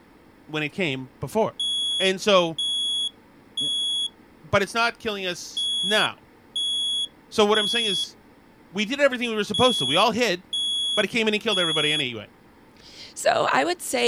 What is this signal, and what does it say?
Alarm pattern, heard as an alarm's beeps, played three times, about 3350 Hz, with speech in English. Temporal three. Smoke or fire, evacuate.